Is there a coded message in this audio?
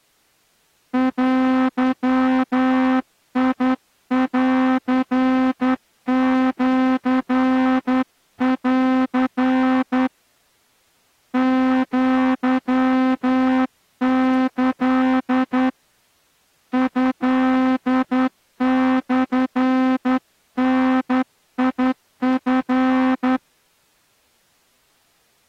Yes: Morse code (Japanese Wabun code) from 0.9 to 23.4 s, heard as a horn, hand-sent with a straight key, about 10 wpm. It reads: デンシン アキ トモダチ